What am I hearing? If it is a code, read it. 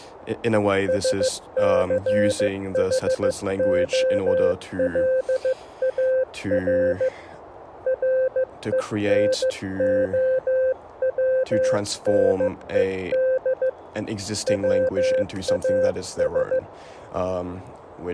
Morse code, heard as a keyed tone, hand-sent with a paddle, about 15 wpm, 520 Hz, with speech in English. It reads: SCHOLAR RENOWNED WAS